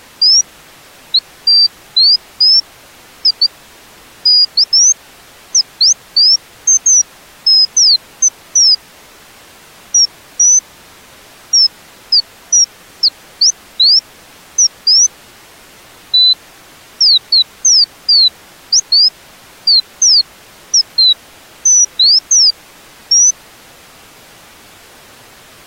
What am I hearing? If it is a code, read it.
Bird-like chirps. There is no code.